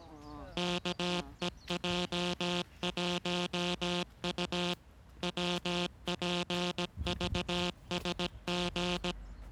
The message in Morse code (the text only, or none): KEJ1U WPVSG